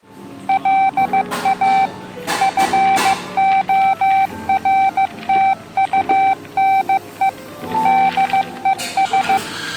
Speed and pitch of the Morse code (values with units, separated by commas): 15 wpm, 780 Hz